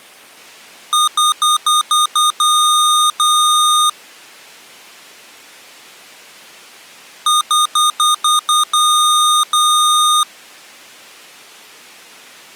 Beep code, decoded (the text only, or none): 6 short, 2 long